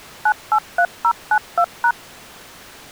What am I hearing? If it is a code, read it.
DTMF, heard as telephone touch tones, dialled by machine, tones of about 70 ms. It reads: 983092#